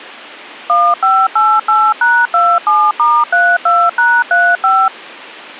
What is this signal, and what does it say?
DTMF, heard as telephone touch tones, dialled by machine, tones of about 240 ms. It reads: 1588#27*32#35